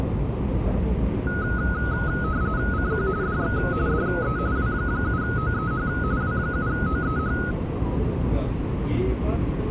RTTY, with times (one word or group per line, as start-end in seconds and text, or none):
2.7-3.1 CQ
3.2-3.6 DX
3.9-4.4 DE
4.6-5.9 W7OEH
6.2-7.4 W7OEH